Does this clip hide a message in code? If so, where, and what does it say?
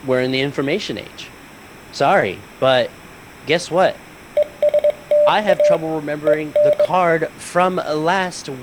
Yes: Morse code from 4.3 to 6.9 s, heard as a keyed tone, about 20 wpm, 590 Hz, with speech in English. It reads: ESTA EN